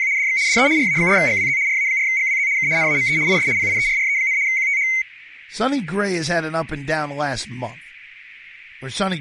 RTTY (75 baud, 170 Hz shift), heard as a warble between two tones, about 2150 Hz centre, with speech in English. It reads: … DX DE RA4GWZ RA4GWZ K NAME IS PIERRE, QTH